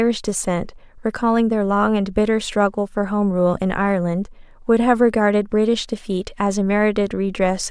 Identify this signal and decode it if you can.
Speech in English. There is no code.